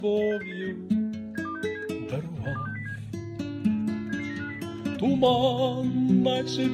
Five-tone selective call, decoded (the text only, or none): 06689 72607 72607 77950